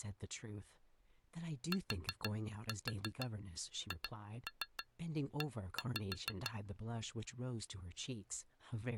Tap code, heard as taps on glass, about 6 knocks a second, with speech in English. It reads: THE